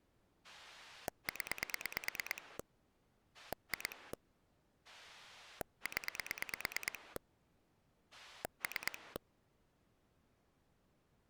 Pulse dialling, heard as a rotary dial, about 9 pulses a second. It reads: 0 2 0 3